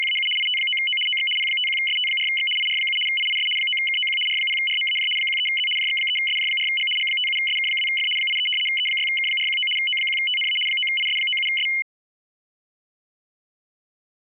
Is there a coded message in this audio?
Yes: RTTY (75 baud, 850 Hz shift) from 0.0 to 11.8 s, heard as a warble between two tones, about 2550 Hz centre. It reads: … IT9O OX P51ST4X IR7 IIS 9KOQ R0RMAJ 13Z JX3SJ4G G57SK2F 83 E6K419 O1TNA 9IS97S